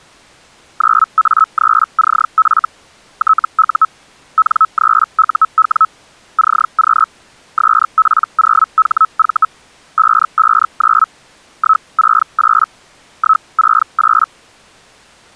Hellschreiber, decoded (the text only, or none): 9A3CF TU N3UW CQ SP0HV 559 168 168